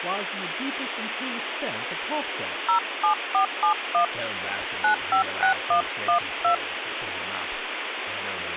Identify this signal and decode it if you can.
DTMF, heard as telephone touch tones, dialled by hand, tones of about 100 ms, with phone line noise and speech in English. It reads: 07471 956112